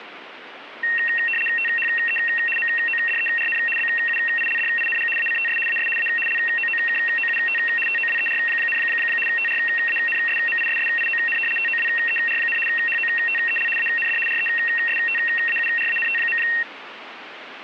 RTTY (75 baud, 850 Hz shift), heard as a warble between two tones, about 2300 Hz centre, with radio static. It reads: THE MODERN BUILDING ACTS AS A LOOKOUT TOWER, TRANSMISSION TOWER, HOTEL AND RESTAURANT.